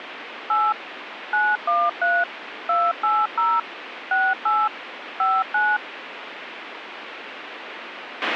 DTMF, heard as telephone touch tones, dialled by machine, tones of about 220 ms, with radio hiss and a squelch burst at the end. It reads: 8 913 280 68 59